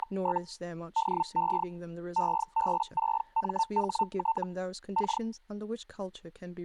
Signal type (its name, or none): Hellschreiber